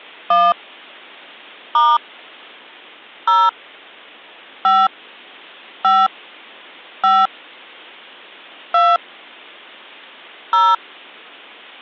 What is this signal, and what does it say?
DTMF, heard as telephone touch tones, dialled by hand, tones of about 220 ms. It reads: 1 * 0 5 5 5 2 0